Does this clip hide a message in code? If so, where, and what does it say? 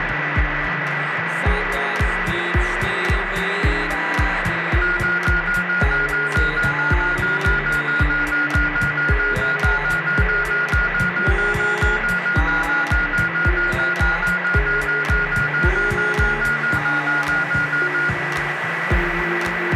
No, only evenly repeated beeps, with radio static and a steady whistle near 1960 Hz.